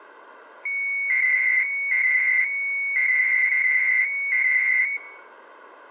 300-baud modem data (Bell 103 tones), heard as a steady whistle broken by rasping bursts, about 300 baud, 200 Hz shift.